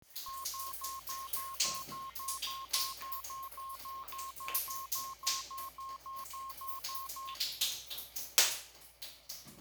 Evenly repeated beeps, with the noise of a restroom. There is no code.